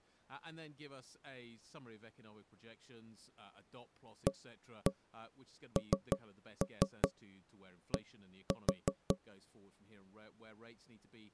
Tap code, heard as knocks on wood, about 5 knocks a second, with speech in English. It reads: AND